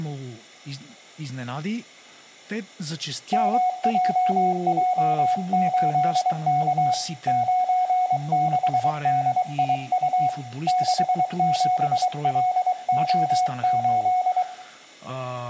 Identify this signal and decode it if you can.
Morse code, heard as a keyed tone, hand-sent with a paddle, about 23 wpm, 730 Hz, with room echo and speech in Bulgarian. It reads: MJJ8K 96DIU 67LO8